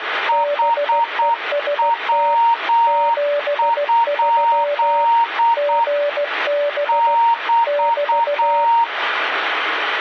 Morse code, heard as two keyed tones, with radio static. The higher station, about 8 wpm, 930 Hz: HW? <BT>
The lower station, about 16 wpm, 580 Hz: BEST 73 GB <BT>